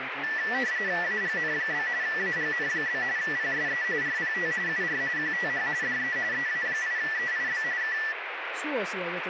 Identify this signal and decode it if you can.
RTTY (45.45 baud, 170 Hz shift), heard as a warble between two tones, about 1850 Hz centre, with radio static and speech in Finnish. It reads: AGN? AGN? PSE RPT UR QTH DE EA8EIB K